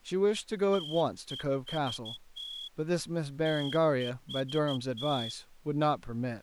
Morse code, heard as a whistle, hand-sent with a straight key, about 13 wpm, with speech in English. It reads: TEST TEST